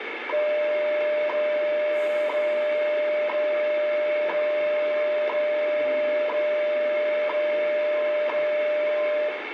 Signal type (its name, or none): radio time signal